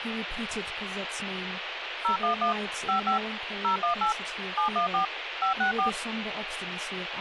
DTMF, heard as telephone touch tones, dialled by machine, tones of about 110 ms, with phone line noise and speech in English. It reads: 011 55 018 714 564